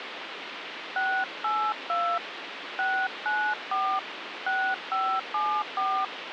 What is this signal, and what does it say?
DTMF, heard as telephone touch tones, dialled by hand, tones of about 280 ms, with phone line noise. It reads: 682 694 6574